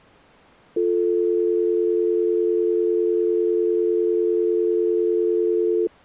Telephone call progress tone (North American or UK plan), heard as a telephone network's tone, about 350, 440 Hz. Dial tone.